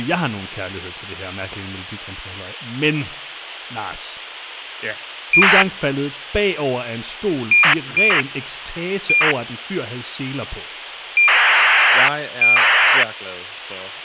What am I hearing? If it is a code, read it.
ACARS aircraft data, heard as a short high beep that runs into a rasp, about 2400 baud, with radio hiss and speech in Danish.